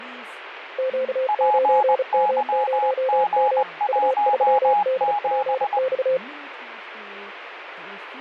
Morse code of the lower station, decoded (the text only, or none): Q9M0M U3DPX